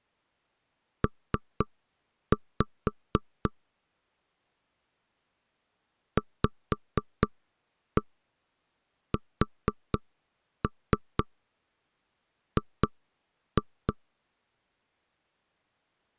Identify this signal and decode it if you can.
Tap code, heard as knocks on wood, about 4 knocks a second. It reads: P VSG